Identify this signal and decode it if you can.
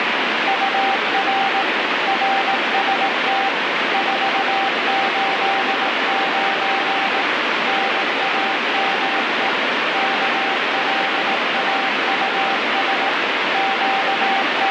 Morse code, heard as a keyed tone, machine-sent, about 18 wpm, 780 Hz, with heavy radio static. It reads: UR RST 489 NAME KLAUS …